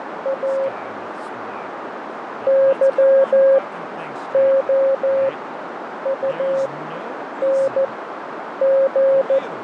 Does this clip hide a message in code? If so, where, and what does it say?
Yes: Morse code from 0.2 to 9.4 s, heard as a keyed tone, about 14 wpm, spaced as for 8 wpm, 540 Hz, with radio static, fading, a narrow filter and speech in English. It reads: A YOUNG